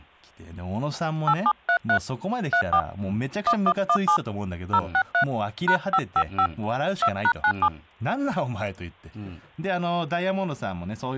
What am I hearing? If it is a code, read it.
DTMF, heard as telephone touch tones, dialled by hand, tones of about 70 ms, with hum and speech in Japanese. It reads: 8733 34 1117 063 #555 2#97